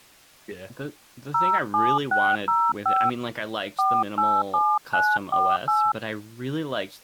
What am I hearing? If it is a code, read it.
DTMF, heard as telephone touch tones, dialled by hand, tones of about 240 ms, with speech in English. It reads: 07605 487948